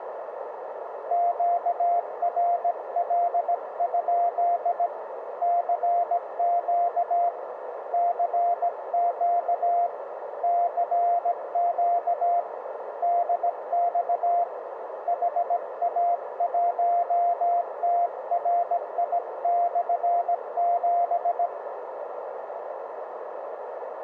Morse code, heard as a keyed tone, hand-sent with a bug key, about 17 wpm, 700 Hz, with radio static and a narrow filter. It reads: QRL? CQ CQ CQ DX HA1TRI/7